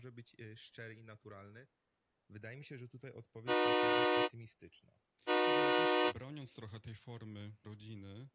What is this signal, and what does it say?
Train horn signal, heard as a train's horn, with speech in Polish. 2 short. On North American railways: a signal is acknowledged.